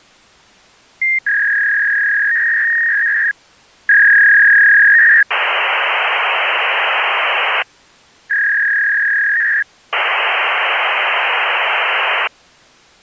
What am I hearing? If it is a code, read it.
Fax machine handshake, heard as a warble and hiss.